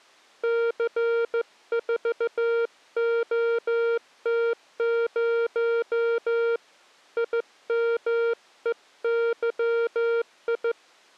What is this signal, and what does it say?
Morse code, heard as a keyed tone, hand-sent with a straight key, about 15 wpm, 460 Hz. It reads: C4OT0 IMEYI